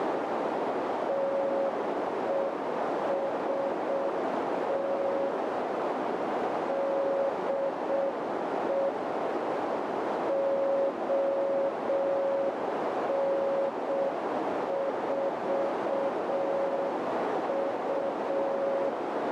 Morse code, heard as a keyed tone, machine-sent, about 6 wpm, 550 Hz, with heavy radio static and a narrow filter. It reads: TEST DE ON4U